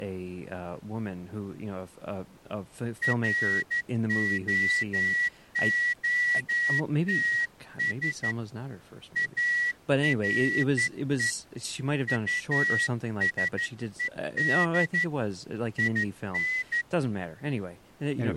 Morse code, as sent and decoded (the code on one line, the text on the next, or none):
.-. --- --- - ... / .- .-. . / ..- ... . -.. / .. -.
ROOTS ARE USED IN